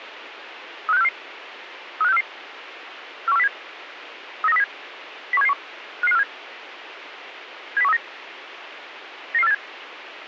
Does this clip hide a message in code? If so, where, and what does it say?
Yes: five-tone selective call (EEA) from 0.9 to 9.5 s, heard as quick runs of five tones, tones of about 40 ms, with radio hiss and a squelch burst at the end. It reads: 35644 35644 41407 39307 01771 55547 70139 99487